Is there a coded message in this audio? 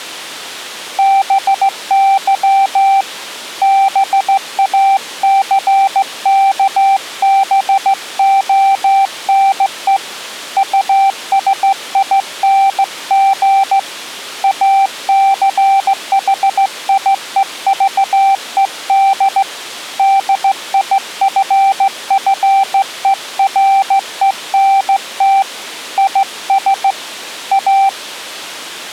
Yes: Morse code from 0.9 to 28.0 s, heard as a keyed tone, hand-sent with a straight key, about 15 wpm, 780 Hz. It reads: BY BACKBONE USING ACHIEVED DIFFERENT IS A